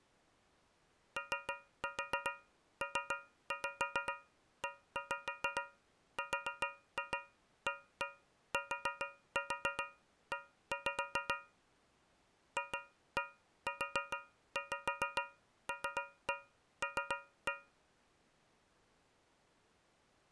Tap code, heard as taps on a metal pipe, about 7 knocks a second. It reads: OPERATE FULL